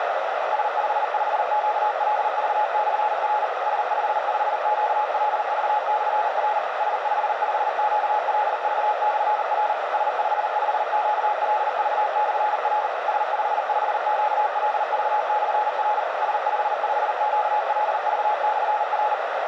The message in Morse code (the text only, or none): S55QLV/R S55QLV/R S55QLV/R S55QLV/R S55QLV/R S55QLV/R